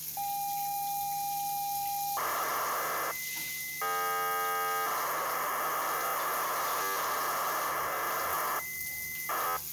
ZX Spectrum tape loading, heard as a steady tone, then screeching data, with the noise of a restroom.